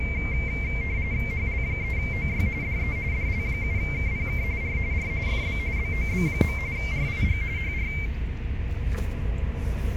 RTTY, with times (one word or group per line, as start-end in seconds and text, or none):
1.3-2.5 HL3OY
2.6-3.0 DE
3.1-4.4 DL7KPK
4.6-4.8 R
4.9-5.1 R
5.3-5.6 FB
5.8-6.6 BOB.
6.8-7.4 RIG
7.6-7.9 HR